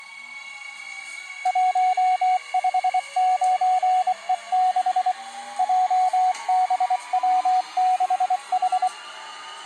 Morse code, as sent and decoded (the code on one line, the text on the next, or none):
.---- ..... ----. . -.... / .--- -... .-- -.... ....
159E6 JBW6H